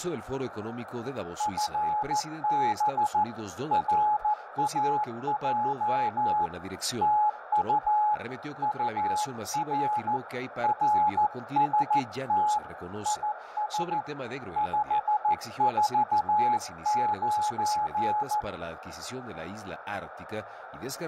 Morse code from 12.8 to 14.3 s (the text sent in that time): IS